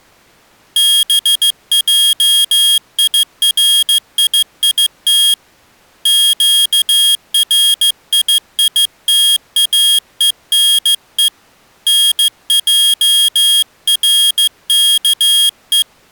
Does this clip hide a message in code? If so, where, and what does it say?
Yes: Morse code (Hebrew alphabet) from 0.7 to 15.9 s, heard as a high beeper, hand-sent with a straight key, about 15 wpm, 3250 Hz. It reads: בעיריית קרייתאונו נערכו